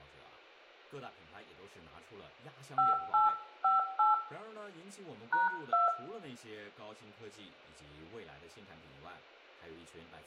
DTMF, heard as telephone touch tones, dialled by hand, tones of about 160 ms, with room echo and speech in Chinese. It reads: 5858 #2